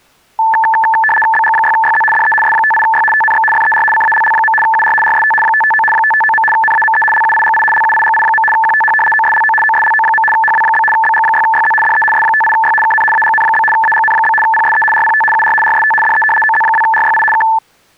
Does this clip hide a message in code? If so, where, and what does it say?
Yes: RTTY (75 baud, 850 Hz shift) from 0.4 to 17.6 s, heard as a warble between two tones, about 1320 Hz centre. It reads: BG6YZ DE S58Y TNX FER CALL. UR RST 559 559. NAME LUIGI LUIGI. QTH OSLO OSLO. HW? BG6YZ DE S58Y KN AGN? AGN? PSE RPT UR RST DE OZ2RYI K